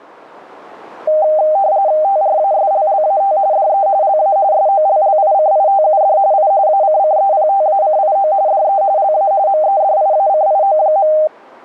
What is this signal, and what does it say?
RTTY (45.45 baud, 170 Hz shift), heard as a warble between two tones, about 700 Hz centre. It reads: TRASLLAT DE LA SOLLICITUD I ACCEPTACIO DE LA MEDIACIO.